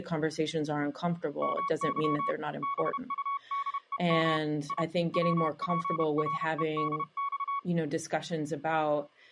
Morse code (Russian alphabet), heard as a keyed tone, hand-sent with a paddle, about 31 wpm, 1120 Hz, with speech in English. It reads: МЫ БУДЕМ И ВПРЕДЬ